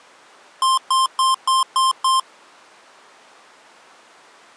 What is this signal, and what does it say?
Beep code, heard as beeps from a small speaker, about 1050 Hz. 6 short. In AMI BIOS tables: keyboard controller gate A20 failure; in Dell tables: video card failure.